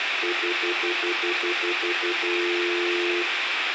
Telephone call progress tone (North American plan), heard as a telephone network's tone, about 350, 440 Hz, 0.1 s on and 0.1 s off, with phone line noise. Stutter dial tone.